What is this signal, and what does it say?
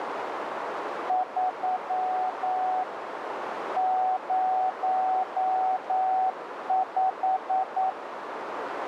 Morse code, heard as a keyed tone, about 9 wpm, 750 Hz, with radio static and a narrow filter. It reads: 3 05